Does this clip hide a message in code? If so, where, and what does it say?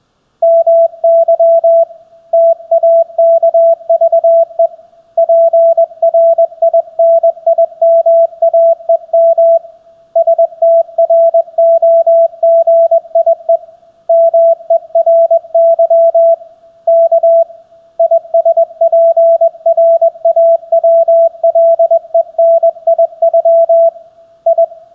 Yes: Morse code (Russian alphabet) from 0.4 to 24.7 s, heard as a keyed tone, hand-sent with a paddle, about 21 wpm, 670 Hz. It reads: МЫ ТАКЖЕ ПРИНИМАЕМ СТРОГИЕ МЕРЫ К ИСПРАВЛЕНИЮ И